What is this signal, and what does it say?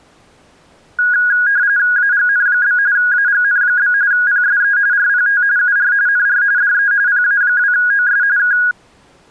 RTTY (45.45 baud, 170 Hz shift), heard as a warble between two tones, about 1550 Hz centre. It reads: AGN? AGN? PSE RPT UR NR DE PA2OS K